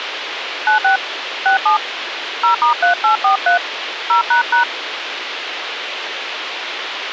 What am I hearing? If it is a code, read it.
DTMF, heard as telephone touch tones, dialled by hand, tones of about 120 ms, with radio hiss. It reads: 96 67 0*3843 0##